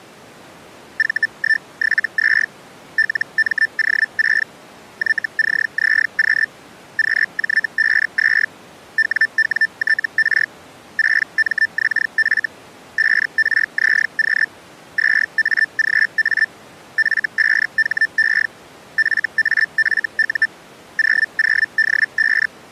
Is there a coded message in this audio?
Yes: Hellschreiber (Feld-Hell, 122.5 baud) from 1.0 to 22.5 s, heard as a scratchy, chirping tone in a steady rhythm, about 1800 Hz. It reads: V172 LMO6 YCZQ QJ52 WWTR 6MXF 5RZQ 2AGA F5HE FAFU 00D5